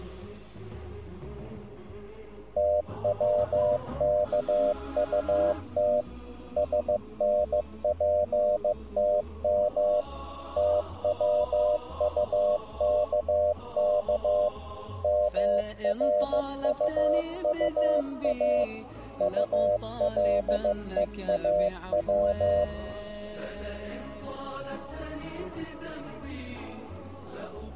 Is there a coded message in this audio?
Yes: Morse code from 2.5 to 22.7 s, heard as a keyed tone, machine-sent, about 15 wpm, 600 Hz. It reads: TWKUT SNPTM TWUKK MRUUA ULEAW